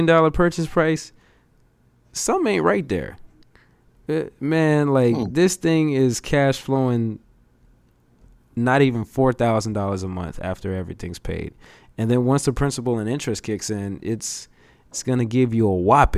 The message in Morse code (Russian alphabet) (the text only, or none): none